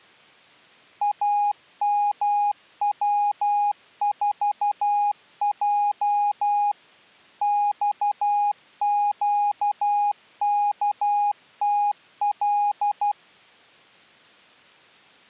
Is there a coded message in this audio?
Yes: Morse code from 1.0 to 13.2 s, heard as a keyed tone, machine-sent, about 12 wpm, 820 Hz. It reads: AMW4J XQKTL